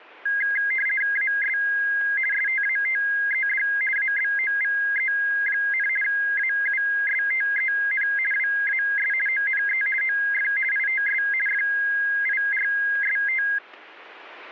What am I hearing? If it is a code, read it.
RTTY (50 baud, 450 Hz shift), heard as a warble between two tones, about 1850 Hz centre. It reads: AS STATED ABOVE, AUSTEN WAS ONE OF ITS FIRST